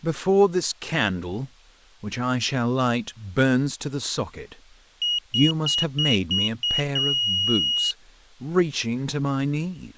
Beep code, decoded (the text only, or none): 6 short, 1 long